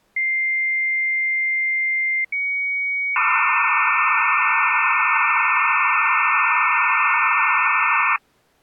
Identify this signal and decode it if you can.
Dial-up modem handshake (low-speed, two carriers), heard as two whistles, then hiss.